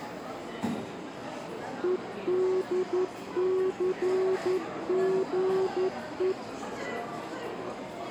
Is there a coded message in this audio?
Yes: Morse code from 1.8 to 6.4 s, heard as a keyed tone, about 11 wpm, 380 Hz, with the noise of a restaurant. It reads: EDCGE